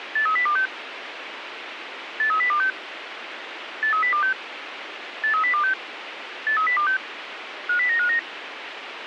Five-tone selective call (CCIR), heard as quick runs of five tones, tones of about 100 ms, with radio hiss. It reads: 83026 83026 83026 83026 83026 50959